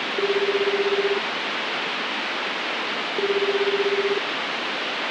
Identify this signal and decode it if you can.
Telephone call progress tone (Japanese plan), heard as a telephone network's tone, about 380, 400, 420 Hz, 1 s on and 2 s off, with phone line noise. Ringback tone.